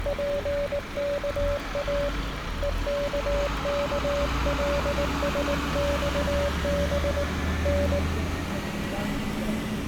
Morse code (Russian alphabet), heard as a keyed tone, hand-sent with a paddle, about 19 wpm, 570 Hz, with street noise. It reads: ПКА ЕККЛСЬБ Н